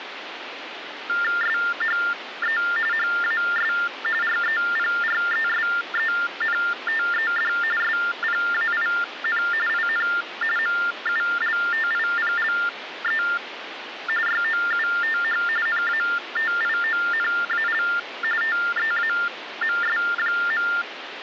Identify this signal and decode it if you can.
TTY/TDD text telephone tones (45.45 baud Baudot), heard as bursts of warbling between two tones, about 400 Hz shift, 1600 Hz centre, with phone line noise. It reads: SHE HAS REPRESENTED SPAIN IN MULTIPLE YOUTH NATIONAL TEAMS.